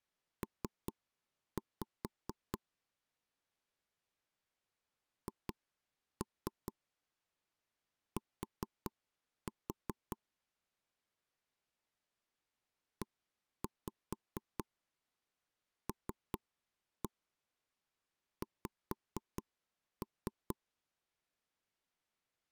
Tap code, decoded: P HT ELX

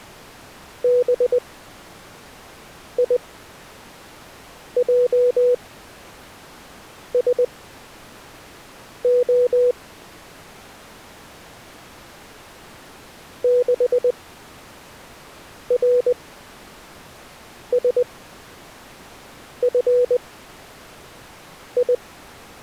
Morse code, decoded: BIJSO 6RSFI

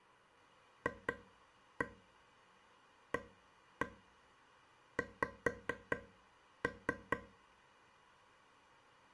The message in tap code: FAX

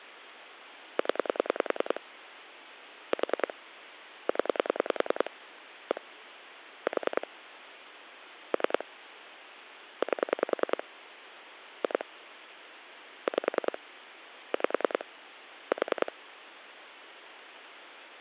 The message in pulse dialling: 0 4 0 1 4 3 8 2 5 5 4

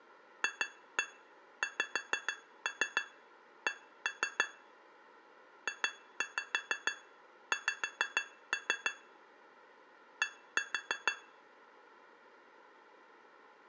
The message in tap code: FXC JX D

